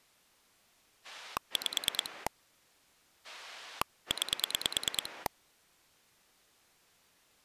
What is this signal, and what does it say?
Pulse dialling, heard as a rotary dial, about 9 pulses a second. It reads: 5 9